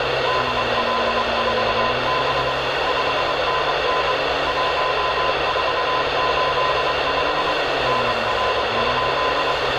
Morse code, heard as a keyed tone, machine-sent, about 24 wpm, 1020 Hz, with heavy radio static and street noise. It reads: DL4B 5NN 1485 NR?